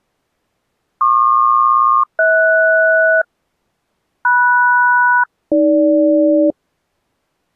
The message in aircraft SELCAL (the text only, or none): PQ-HS MS-AG